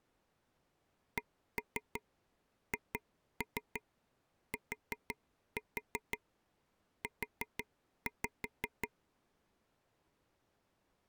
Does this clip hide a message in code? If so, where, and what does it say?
Yes: tap code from 1.2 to 8.9 s, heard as taps on a table, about 5 knocks a second. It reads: CHTU